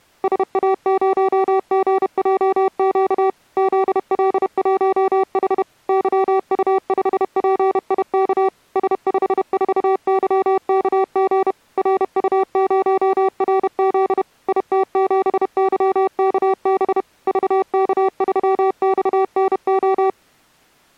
Morse code, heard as electronic beeps, machine-sent, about 31 wpm, 380 Hz. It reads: SA0GJQ ZL1H YU5PIK S54YKG RU0RZ IT7YKB VK3XNO